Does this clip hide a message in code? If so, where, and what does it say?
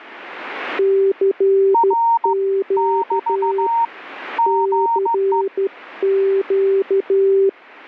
Yes: Morse code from 0.7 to 7.6 s, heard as two keyed tones. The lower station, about 13 wpm, 390 Hz: CQ CQ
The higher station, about 15 wpm, 920 Hz: R <BT> GE